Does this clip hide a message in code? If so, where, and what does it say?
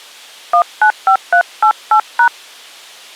Yes: DTMF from 0.5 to 2.3 s, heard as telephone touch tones, dialled by hand, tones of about 90 ms. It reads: 195388#